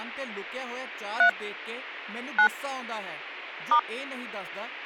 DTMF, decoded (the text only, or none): 3 9 *